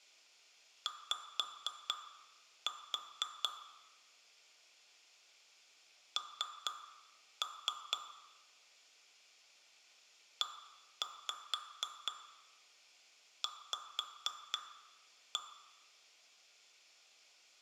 Tap code, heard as taps on glass, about 4 knocks a second. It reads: Y N EV